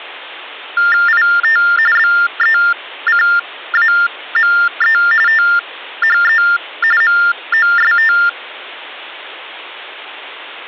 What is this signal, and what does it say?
TTY/TDD text telephone tones (45.45 baud Baudot), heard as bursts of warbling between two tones, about 400 Hz shift, 1600 Hz centre. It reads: IT BECAME THE MOST